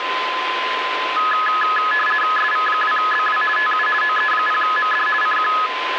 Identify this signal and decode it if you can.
RTTY (50 baud, 450 Hz shift), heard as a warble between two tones, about 1480 Hz centre, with radio static and a steady whistle near 1030 Hz. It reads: SV2BW TU OE0MD CQ